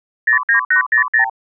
Multi-frequency trunk signalling (R2, with the far end's replies), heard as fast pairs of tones, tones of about 110 ms. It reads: 09800